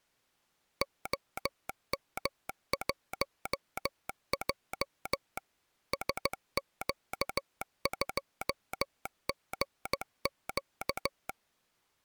Morse code, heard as a telegraph sounder, machine-sent, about 15 wpm. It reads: OM1J SQ2GQ